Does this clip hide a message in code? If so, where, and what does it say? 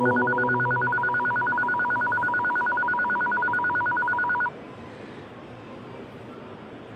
No, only a tone that alternates evenly between two pitches.